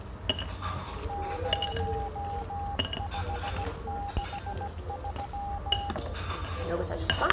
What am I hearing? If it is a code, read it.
Morse code, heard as a keyed tone, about 17 wpm, 810 Hz, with the noise of a restaurant. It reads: 0563